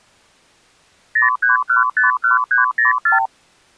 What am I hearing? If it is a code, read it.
Multi-frequency trunk signalling (R2, with the far end's replies), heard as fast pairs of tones, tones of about 140 ms. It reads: 03151304